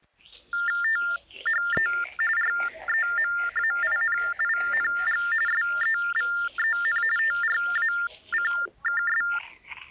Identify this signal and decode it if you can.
TTY/TDD text telephone tones (45.45 baud Baudot), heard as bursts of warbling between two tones, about 400 Hz shift, 1600 Hz centre, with the noise of a restroom. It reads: THE REMAINING SEVEN TRACKS